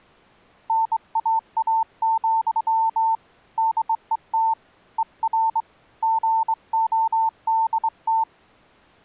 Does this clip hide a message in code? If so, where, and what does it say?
Yes: Morse code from 0.6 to 8.3 s, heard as a keyed tone, hand-sent with a straight key, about 23 wpm, 900 Hz. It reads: NAA, DET ER GODT